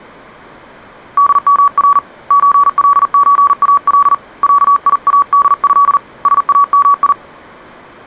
Morse code (Arabic alphabet), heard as a keyed tone, hand-sent with a paddle, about 40 wpm, 1140 Hz. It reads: دمر زلزال عياده سامي